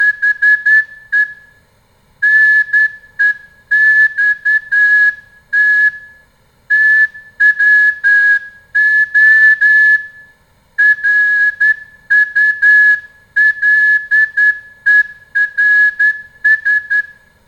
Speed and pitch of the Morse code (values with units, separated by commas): 10 wpm